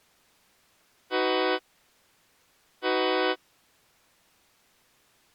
Train horn signal, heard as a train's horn. 2 short. On North American railways: a signal is acknowledged.